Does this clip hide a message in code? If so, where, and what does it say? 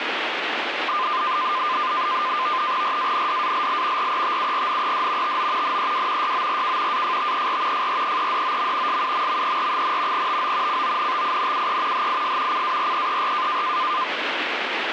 Yes: NAVTEX (SITOR-B), 100 baud, 170 Hz shift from 0.9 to 14.0 s, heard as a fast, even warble, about 1120 Hz centre, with radio static. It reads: RANDALL RETURNED TO NEW YORK AFTER FREEDOM SUMMER, TO CONTINUE HIS CAREER